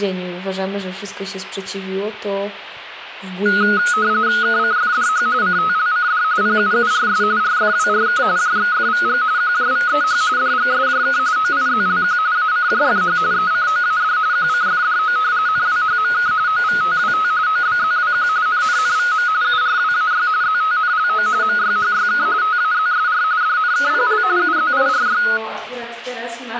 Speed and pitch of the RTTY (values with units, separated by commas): 45.45 baud, 170 Hz shift, 1360 Hz centre